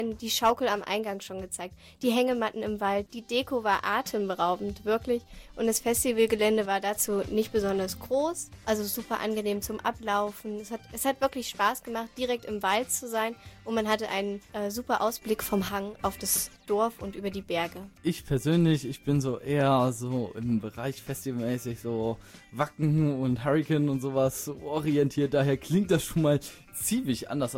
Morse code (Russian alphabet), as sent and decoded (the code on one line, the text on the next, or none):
none